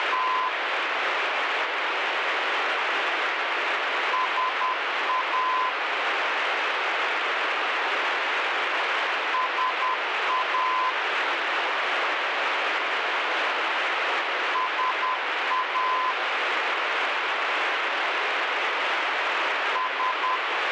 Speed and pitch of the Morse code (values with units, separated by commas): 10 wpm, 1020 Hz